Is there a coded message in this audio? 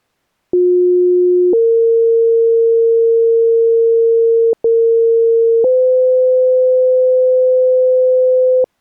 Yes: two-tone page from 0.5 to 8.6 s, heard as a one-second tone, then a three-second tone, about 360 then 460 Hz, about 460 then 510 Hz.